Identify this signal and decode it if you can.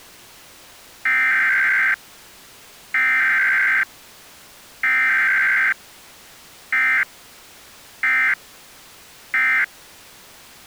Emergency Alert System (SAME) tones (header bursts, then end-of-message bursts), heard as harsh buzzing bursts, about 520.83 baud.